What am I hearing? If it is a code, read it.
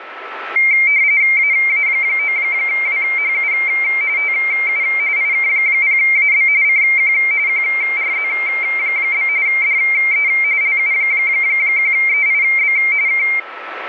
RTTY (45.45 baud, 170 Hz shift), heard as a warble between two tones, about 2200 Hz centre, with radio static and a steady whistle near 1320 Hz. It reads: AA9WHU TU IK0AB CQ QRZ? DE LU1EIB K